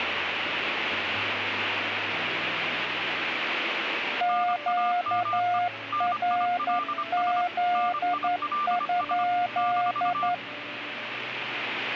Morse code, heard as two keyed tones, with radio static. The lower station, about 11 wpm, 710 Hz: QRZ?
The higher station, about 25 wpm, 1190 Hz: NAME NILS NILS -